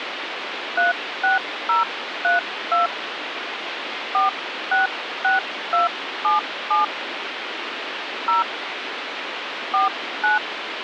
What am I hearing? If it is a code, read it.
DTMF, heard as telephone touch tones, dialled by hand, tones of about 140 ms, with phone line noise. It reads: 36032 466277 0 49